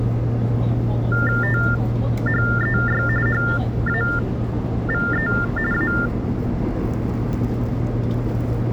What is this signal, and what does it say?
TTY/TDD text telephone tones (45.45 baud Baudot), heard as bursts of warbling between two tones, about 400 Hz shift, 1600 Hz centre, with the noise inside a subway train. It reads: THEY HAVE A